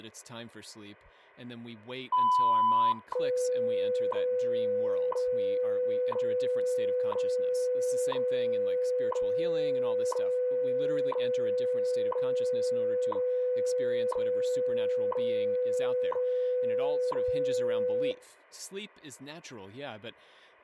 Radio time signal (WWV, Colorado), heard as ticks, one a second, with speech in English.